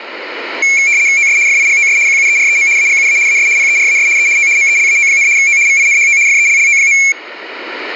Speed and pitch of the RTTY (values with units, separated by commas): 75 baud, 170 Hz shift, 2250 Hz centre